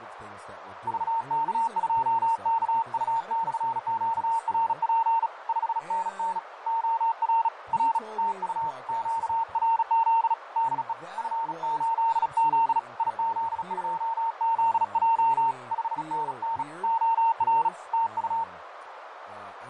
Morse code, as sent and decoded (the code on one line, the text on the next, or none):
...- -.- ..--- -.- ..- -..-. --.- .-. .--. / ..... -. -. / --- .-. / .-. / - ..- / --.- .-. --.. / -.. . / ..-. ---.. --.. / .. --.. ..--- --.. .--- / ..... -. -. / --- .-. / - ..-
VK2KU/QRP 5NN OR R TU QRZ DE F8Z IZ2ZJ 5NN OR TU